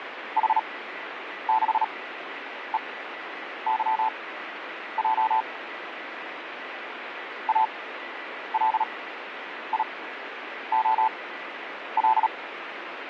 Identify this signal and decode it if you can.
Morse code, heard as a keyed tone, machine-sent, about 37 wpm, spaced as for 9 wpm, 880 Hz, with radio static and a weaker station near 1970 Hz. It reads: H6EYJ ALIOL